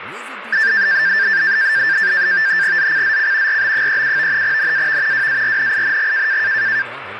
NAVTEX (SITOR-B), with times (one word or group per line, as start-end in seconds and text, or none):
2.8-3.6 ZCZC
3.5-4.4 RB37
4.4-5.3 NAV
5.1-6.4 WARNING